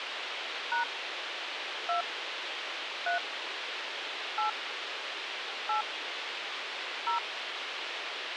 DTMF, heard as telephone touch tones, dialled by hand, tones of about 120 ms, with radio hiss. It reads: # 2 3 8 8 0